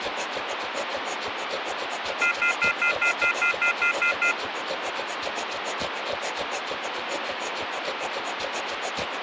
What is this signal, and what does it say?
Telephone call progress tone (North American plan), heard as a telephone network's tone, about 1400, 2050, 2450, 2600 Hz, 0.1 s on and 0.1 s off, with phone line noise. Off-hook warning tone.